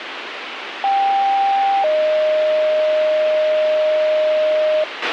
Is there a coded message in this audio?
Yes: two-tone page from 0.8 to 4.8 s, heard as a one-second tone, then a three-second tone, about 790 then 620 Hz, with radio hiss and a squelch burst at the end.